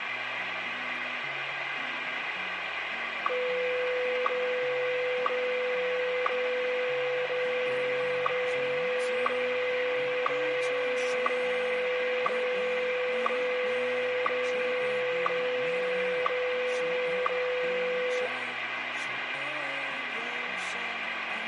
Radio time signal (WWVH, Hawaii), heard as ticks, one a second, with radio static and room echo.